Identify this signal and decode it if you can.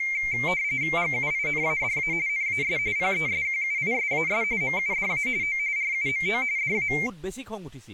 RTTY (45.45 baud, 170 Hz shift), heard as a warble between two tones, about 2200 Hz centre, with speech in Assamese. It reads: GUINADA NAS PESQUISAS MUDA O RUMO DA